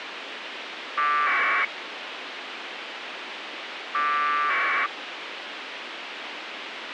Packet radio (AX.25, as in APRS), 1200 baud, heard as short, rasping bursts, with radio hiss.